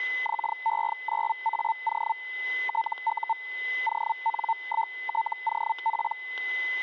Hellschreiber (Feld-Hell, 122.5 baud), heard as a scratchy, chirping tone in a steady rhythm, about 900 Hz, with static crashes and a steady whistle near 2020 Hz. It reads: XE9AO TU ON1TOP